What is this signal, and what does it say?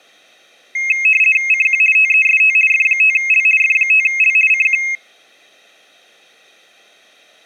RTTY (50 baud, 450 Hz shift), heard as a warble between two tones, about 2350 Hz centre, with room echo. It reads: CQ TEST F5L F5L CQ